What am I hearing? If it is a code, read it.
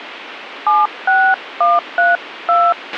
DTMF, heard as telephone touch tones, dialled by hand, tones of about 240 ms, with radio hiss and a squelch burst at the end. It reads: 76132